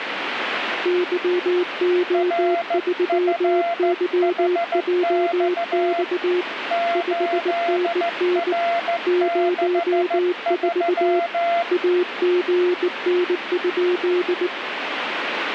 Morse code, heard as two keyed tones, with radio static. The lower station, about 19 wpm, 360 Hz: YO3YJX 5NN 04 AGN?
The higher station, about 14 wpm, 680 Hz: RFHX 8R63